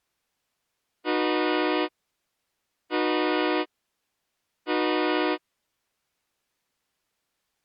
Train horn signal, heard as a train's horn. 3 short. On North American railways: when stopped, the train will back up.